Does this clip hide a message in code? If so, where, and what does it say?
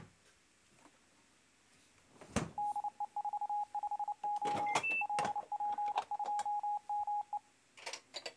Yes: Morse code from 2.5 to 7.4 s, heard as a keyed tone, hand-sent with a paddle, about 29 wpm, 830 Hz, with kitchen noise. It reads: DE45O LP2ME